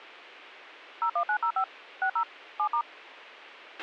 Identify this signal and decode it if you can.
DTMF, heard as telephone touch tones, dialled by machine, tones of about 80 ms, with a squelch burst at the end. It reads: 01905 60 7*